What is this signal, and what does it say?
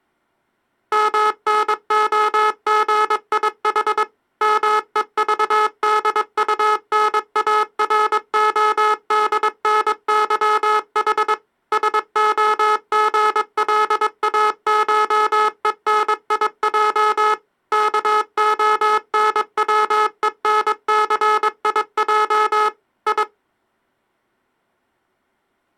Morse code (Russian alphabet), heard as a buzzer, machine-sent, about 22 wpm. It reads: МНОГИХ МЕЖДУНАРОДНЫХ СОГЛАШЕНИЙ КОНВЕНЦИЙ И